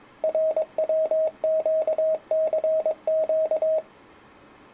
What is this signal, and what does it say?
Morse code, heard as a keyed tone, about 22 wpm, 630 Hz. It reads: RWQCQ